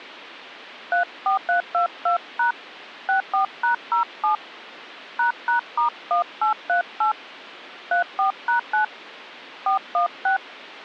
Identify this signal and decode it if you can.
DTMF, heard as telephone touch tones, dialled by hand, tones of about 120 ms. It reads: 34322# 64#07 ##*1838 34#9 416